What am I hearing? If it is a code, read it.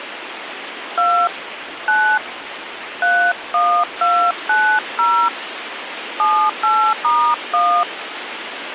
DTMF, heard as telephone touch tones, dialled by hand, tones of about 300 ms, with phone line noise. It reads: 2 9 31290 78*1